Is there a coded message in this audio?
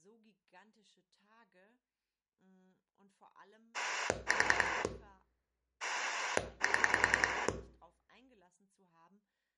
Yes: pulse dialling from 3.7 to 7.5 s, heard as a rotary dial, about 10 pulses a second, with room echo and speech in German. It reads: 4 7